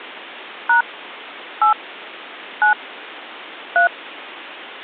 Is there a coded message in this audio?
Yes: DTMF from 0.7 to 3.9 s, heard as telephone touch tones, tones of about 110 ms. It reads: # 8 9 3